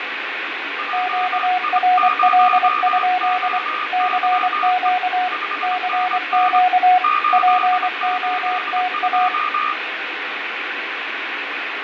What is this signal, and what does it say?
Morse code, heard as two keyed tones, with radio static, fading and room echo. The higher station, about 26 wpm, 1220 Hz: JI0OYE 5NN 882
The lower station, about 24 wpm, 730 Hz: QRL? CQ CQ POTA